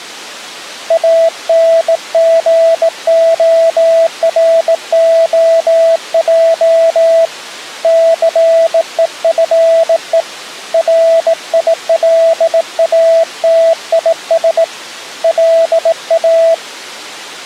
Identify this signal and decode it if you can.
Morse code, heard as a keyed tone, hand-sent with a bug key, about 18 wpm, 660 Hz. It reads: ANGOROJ CEFE RILATIS LA